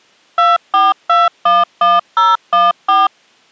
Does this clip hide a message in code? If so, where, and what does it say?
Yes: DTMF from 0.4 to 3.1 s, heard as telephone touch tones, dialled by machine, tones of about 190 ms. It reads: 24211014